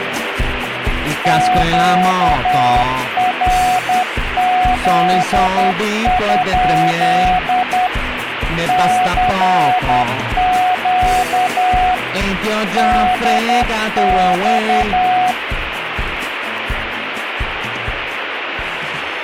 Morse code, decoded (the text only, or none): QRZ? CQ DX